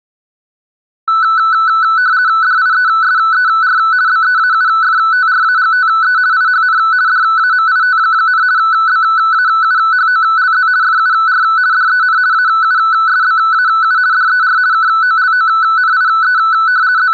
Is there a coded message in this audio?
Yes: RTTY (50 baud, 170 Hz shift) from 1.1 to 17.1 s, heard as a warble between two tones, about 1410 Hz centre. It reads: DIESER BEAUFTRAGTE IHN DAMIT, BAUHOLZ FUR DEN AUSBAU DER KOLONIE …